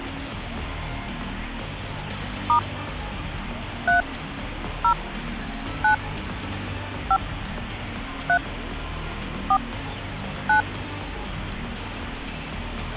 DTMF, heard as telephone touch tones, dialled by hand, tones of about 100 ms. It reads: * 3 0 9 5 3 4 9